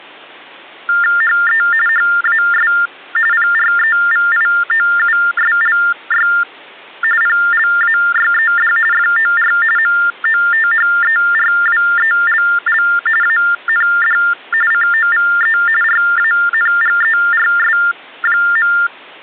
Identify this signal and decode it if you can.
TTY/TDD text telephone tones (45.45 baud Baudot), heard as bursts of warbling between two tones, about 400 Hz shift, 1600 Hz centre. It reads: HE HAS PREVIOUSLY PLAYED FOR MOTHERWELL AND COVE RANGERS.